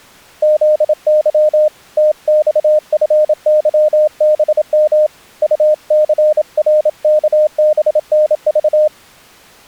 Morse code, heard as a keyed tone, hand-sent with a paddle, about 27 wpm, 610 Hz. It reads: ZY TXFYBM UCRKBNV